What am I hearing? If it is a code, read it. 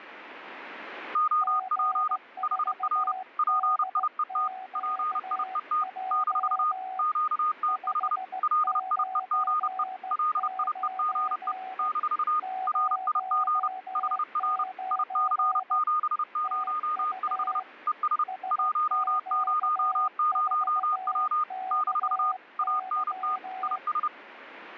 Morse code, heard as two keyed tones. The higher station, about 30 wpm, 1230 Hz: OP HR PIET PIET - QTH LIEGE LIEGE - RIG HR IC705 ES 100W - ANT IS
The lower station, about 16 wpm, 750 Hz: G4DQJ 599 09 TU SQ4KY